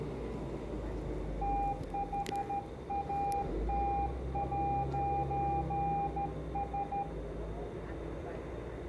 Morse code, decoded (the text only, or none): THAT'S